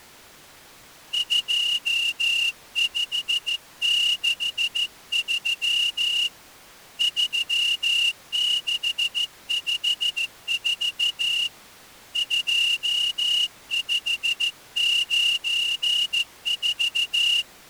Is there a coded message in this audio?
Yes: Morse code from 1.1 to 17.5 s, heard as a whistle, hand-sent with a straight key, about 14 wpm. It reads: 2563 3654 2594